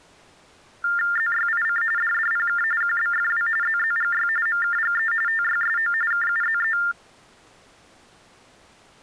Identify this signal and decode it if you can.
TTY/TDD text telephone tones (45.45 baud Baudot), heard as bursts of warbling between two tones, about 400 Hz shift, 1600 Hz centre. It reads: ZYIC DDPK QBFW ZZGY MKGE TYSO KUZE